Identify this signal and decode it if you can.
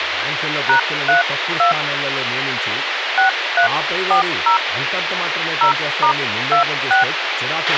DTMF, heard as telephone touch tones, dialled by hand, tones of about 110 ms, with radio hiss, a squelch burst at the end and speech in Telugu. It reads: #32 6340 0*26